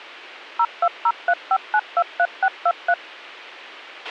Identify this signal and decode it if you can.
DTMF, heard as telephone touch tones, dialled by machine, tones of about 60 ms, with a squelch burst at the end. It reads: 02035923623